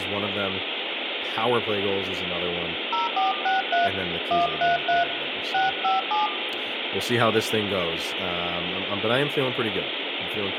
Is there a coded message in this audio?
Yes: DTMF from 2.9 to 6.3 s, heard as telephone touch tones, dialled by hand, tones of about 150 ms, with phone line noise, room echo and speech in English. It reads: 0463 133 657